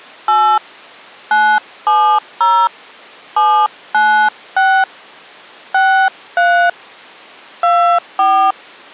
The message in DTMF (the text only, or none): 8 970 796 63 24